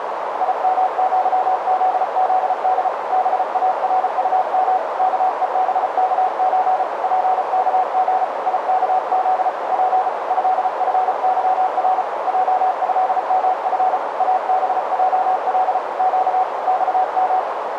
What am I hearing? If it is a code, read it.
Morse code (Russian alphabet), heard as a keyed tone, hand-sent with a paddle, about 34 wpm, 750 Hz, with heavy radio static and a narrow filter. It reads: ИМЪЗЗД БАРУМ КЕБКЧ ПКГ ИКЗ П ЭФЫР ЙЭМФ АБЙЛ Щ ЬМ